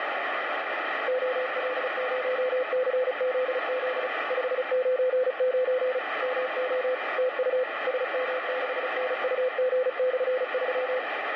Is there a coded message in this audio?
Yes: Morse code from 1.0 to 11.1 s, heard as a keyed tone, machine-sent, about 35 wpm, 510 Hz, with heavy radio static. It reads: OL0CZZ 599 MO TU SM6NUG/3